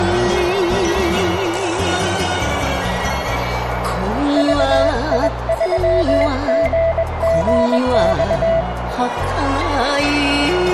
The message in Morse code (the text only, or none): VI3GGX